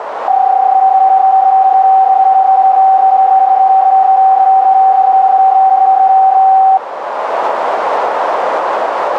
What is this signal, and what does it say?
PSK31 (31.25 baud), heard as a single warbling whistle, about 770 Hz, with radio static and a narrow filter.